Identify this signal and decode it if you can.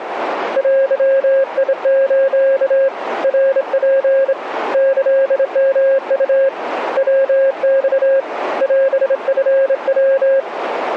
Morse code (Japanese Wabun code), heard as a keyed tone, hand-sent with a straight key, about 26 wpm, 540 Hz, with radio static. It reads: デス ナツ キヨウ ヤマ オチヤ